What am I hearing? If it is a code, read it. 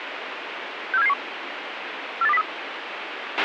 Five-tone selective call (EEA), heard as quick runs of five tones, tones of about 40 ms, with radio hiss and a squelch burst at the end. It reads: 64771 48203